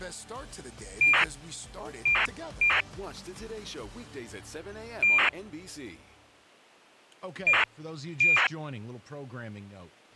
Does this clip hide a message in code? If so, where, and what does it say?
Yes: ACARS aircraft data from 1.0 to 8.5 s, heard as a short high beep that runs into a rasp, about 2400 baud.